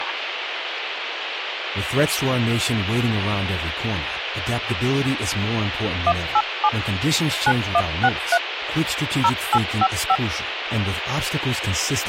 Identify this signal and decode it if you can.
DTMF, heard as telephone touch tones, dialled by machine, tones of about 60 ms, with radio hiss and speech in English. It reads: 187 9163 0855